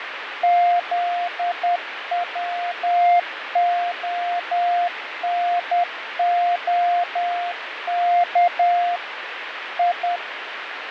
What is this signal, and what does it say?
Morse code (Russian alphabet), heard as a keyed tone, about 10 wpm, 700 Hz, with radio static and fading. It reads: ЗВОНОК И